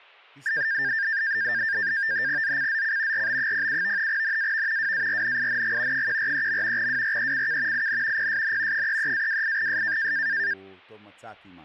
NAVTEX (SITOR-B), 100 baud, 170 Hz shift, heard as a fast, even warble, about 1700 Hz centre, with speech in Hebrew. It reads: ZCZC RB07 NAV WARNING 143. WRECK IN PSN 33-28S